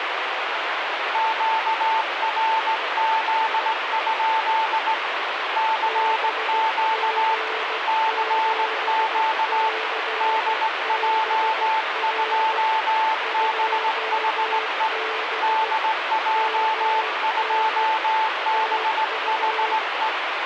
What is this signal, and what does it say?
Morse code, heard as two keyed tones, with heavy radio static. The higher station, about 18 wpm, 880 Hz: QRZ? CQ CQ DJ2BHE DJ2BHE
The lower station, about 16 wpm, 440 Hz: BG7CBR 2B MN TU